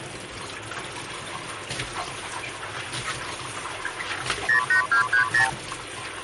Multi-frequency trunk signalling (R2, with the far end's replies), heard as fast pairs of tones, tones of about 110 ms, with kitchen noise. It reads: 08230